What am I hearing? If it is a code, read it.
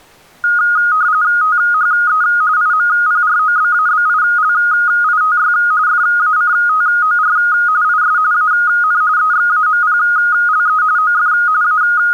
RTTY (45.45 baud, 170 Hz shift), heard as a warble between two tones, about 1340 Hz centre. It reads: THE IMPROBABILITY FACTOR IS AN EXAMPLE OF …